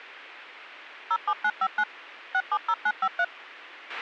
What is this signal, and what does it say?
DTMF, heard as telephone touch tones, dialled by machine, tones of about 60 ms, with a squelch burst at the end. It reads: 07959 670953